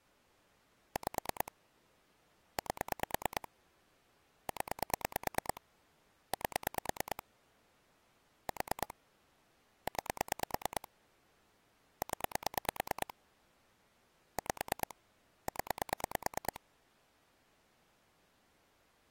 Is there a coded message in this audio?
Yes: pulse dialling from 1.0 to 16.6 s, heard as clicks on a phone line, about 9 pulses a second. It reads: 5 8 0 8 4 9 0 5 0